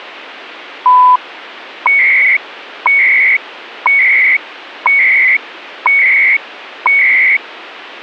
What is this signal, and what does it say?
Radio time signal (CHU, Canada), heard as beeps and data bursts, one a second.